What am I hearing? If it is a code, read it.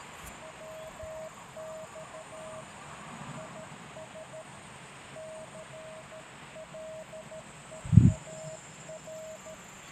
Morse code, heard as a keyed tone, hand-sent with a paddle, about 13 wpm, 630 Hz, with radio static. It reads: WX IS CLEAR